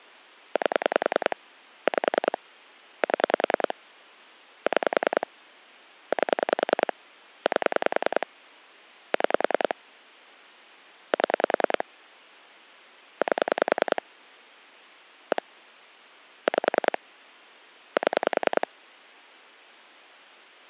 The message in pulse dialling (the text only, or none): 8 5 7 6 8 8 6 7 8 1 5 7